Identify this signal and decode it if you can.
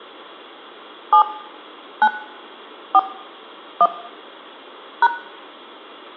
DTMF, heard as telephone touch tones, dialled by hand, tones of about 70 ms, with room echo. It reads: 7 9 4 1 #